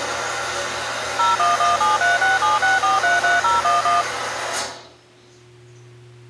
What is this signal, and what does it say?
DTMF, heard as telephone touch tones, dialled by machine, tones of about 160 ms, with the noise of a restroom. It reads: 01173676433011